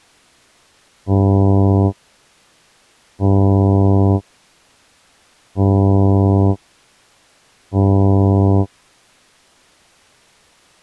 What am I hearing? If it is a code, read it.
Ship horn signal, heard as a ship's horn, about 100 Hz. 4 short. At sea: a pilot vessel's identity signal in fog.